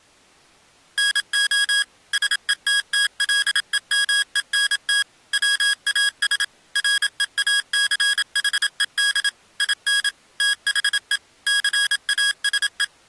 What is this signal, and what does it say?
Morse code, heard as electronic beeps, machine-sent, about 27 wpm, 1650 Hz. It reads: NO SETTLEMENT WAS REACHED IN THE CASE